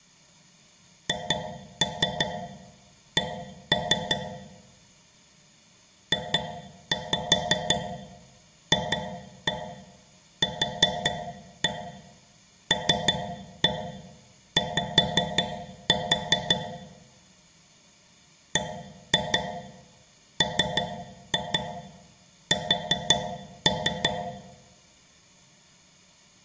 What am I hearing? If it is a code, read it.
Tap code, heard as taps on a metal pipe, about 5 knocks a second, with room echo. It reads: HC JFQLY BMS